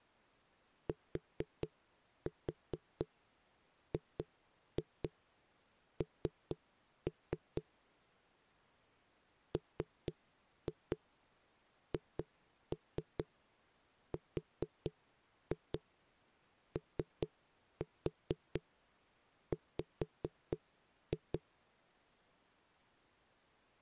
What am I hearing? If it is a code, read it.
Tap code, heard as knocks on a wall, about 4 knocks a second. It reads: TGN MHROW